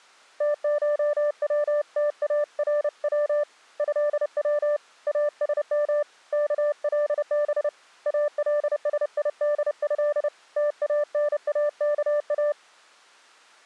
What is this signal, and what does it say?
Morse code (Arabic alphabet), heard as a keyed tone, hand-sent with a paddle, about 30 wpm, 590 Hz. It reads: تشوتارو هو اسم كلب السيده تاناكا